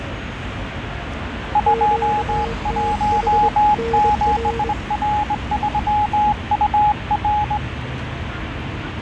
Morse code, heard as two keyed tones, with radio static, fading and street noise. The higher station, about 20 wpm, 840 Hz: 217R3UR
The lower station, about 24 wpm, 460 Hz: QTH NR